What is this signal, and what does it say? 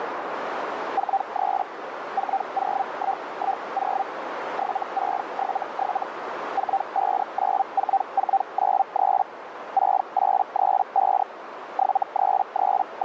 Hellschreiber (Feld-Hell, 122.5 baud), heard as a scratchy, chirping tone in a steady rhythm, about 780 Hz, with radio static and a narrow filter. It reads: 43 40110 7677 4594493 6835 …